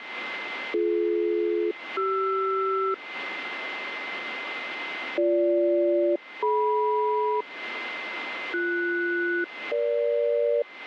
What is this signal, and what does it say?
Aircraft SELCAL, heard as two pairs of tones, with radio static and a steady whistle near 2070 Hz. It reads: BD-CR BG-DM BS-EG